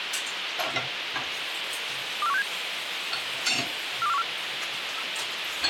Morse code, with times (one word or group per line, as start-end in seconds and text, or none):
none